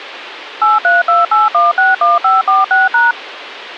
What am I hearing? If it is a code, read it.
DTMF, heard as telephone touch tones, dialled by machine, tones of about 170 ms, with radio hiss and a squelch burst at the end. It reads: 8328161546#